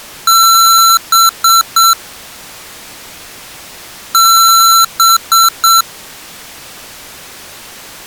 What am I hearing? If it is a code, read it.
Beep code, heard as beeps from a small speaker, played twice, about 1350 Hz. 1 long, 3 short. In Award and IBM BIOS tables: video adapter failure; in AMI BIOS tables: memory failure.